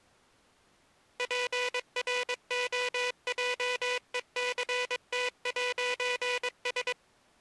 Morse code, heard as a buzzer, machine-sent, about 22 wpm. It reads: PROJECT'S